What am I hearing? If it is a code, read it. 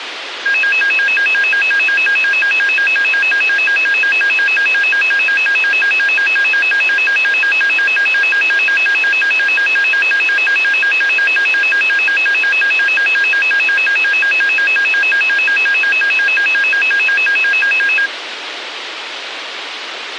A tone that alternates evenly between two pitches, with radio hiss. There is no code.